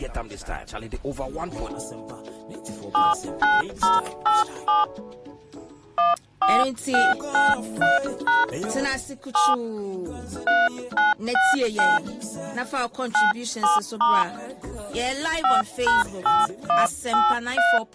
DTMF, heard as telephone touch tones, dialled by hand, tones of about 180 ms. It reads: 79087 14693# 7 3969 97* 5#8183